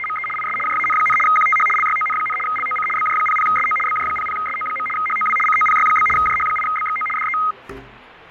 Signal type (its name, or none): RTTY